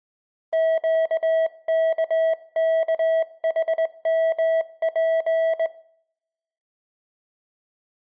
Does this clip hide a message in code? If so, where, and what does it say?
Yes: Morse code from 0.5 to 5.7 s, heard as a keyed tone, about 20 wpm, 650 Hz, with room echo. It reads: QKKHMP